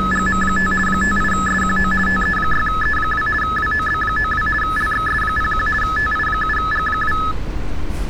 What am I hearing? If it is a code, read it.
RTTY (50 baud, 450 Hz shift), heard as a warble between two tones, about 1500 Hz centre, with street noise. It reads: … 58SQO TE6E2 WOB92 LXS01 TI7G2